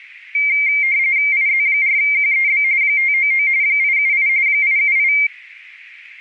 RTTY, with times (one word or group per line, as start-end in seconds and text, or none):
1.3-2.6 IZ4QEB
2.8-3.5 599
3.6-4.3 878
4.5-5.1 878